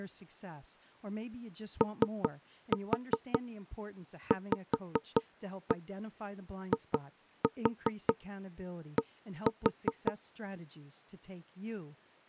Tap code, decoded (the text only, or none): OVID